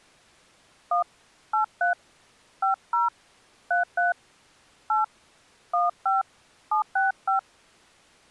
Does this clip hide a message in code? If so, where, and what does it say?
Yes: DTMF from 0.9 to 7.4 s, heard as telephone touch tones, dialled by hand, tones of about 150 ms. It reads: 1 83 50 33 8 15 765